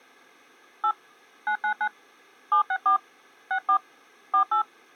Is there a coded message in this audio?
Yes: DTMF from 0.8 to 4.6 s, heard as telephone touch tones, dialled by hand, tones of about 90 ms. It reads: 8 999 764 64 48